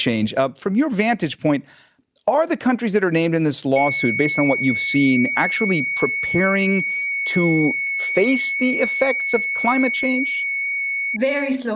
FT8 (one signal), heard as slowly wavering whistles, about 6.25 baud, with speech in English.